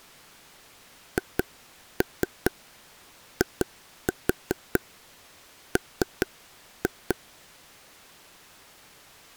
Tap code, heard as taps on a table, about 4 knocks a second. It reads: HIM